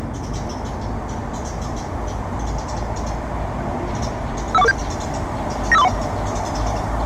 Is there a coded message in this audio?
Yes: five-tone selective call (EIA) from 4.5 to 5.9 s, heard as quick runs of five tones, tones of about 30 ms, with the noise of a residential street. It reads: 51447 95431